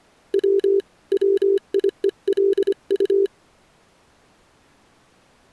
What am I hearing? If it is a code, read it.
Morse code, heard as a keyed tone, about 25 wpm, 390 Hz. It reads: W WIELU